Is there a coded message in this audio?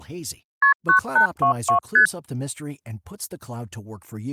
Yes: multi-frequency trunk signalling (R1, as on North American trunks) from 0.6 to 2.1 s, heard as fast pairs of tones, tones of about 100 ms, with speech in Portuguese. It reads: KP 9822 ST